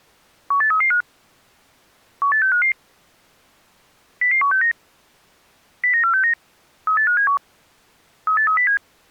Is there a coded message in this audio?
Yes: five-tone selective call (CCIR) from 0.5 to 8.8 s, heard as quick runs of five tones, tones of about 100 ms. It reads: 18335 18655 00169 09469 38571 38307